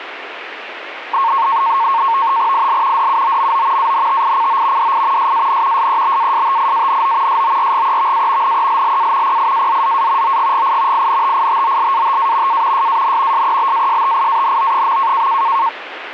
NAVTEX (SITOR-B), 100 baud, 170 Hz shift, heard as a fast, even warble, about 1000 Hz centre, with radio static. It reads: IL DUOMO ANTICO DI SAN SEBASTIANO SORGEVA NELLA PIAZZA OGGI INTITOLATA A SAN SEBASTIANO.